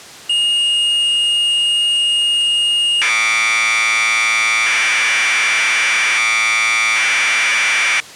Commodore tape loading (standard loader), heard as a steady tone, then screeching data.